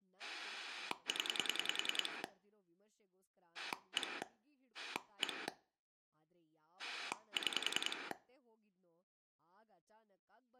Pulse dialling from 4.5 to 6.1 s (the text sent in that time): 1